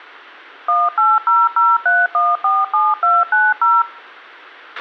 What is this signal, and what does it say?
DTMF, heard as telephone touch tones, dialled by machine, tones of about 210 ms, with a squelch burst at the end. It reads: 18003147290